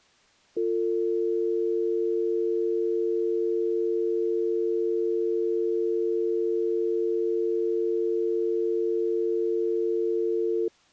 Telephone call progress tone (North American or UK plan), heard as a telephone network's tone, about 350, 450 Hz. Dial tone.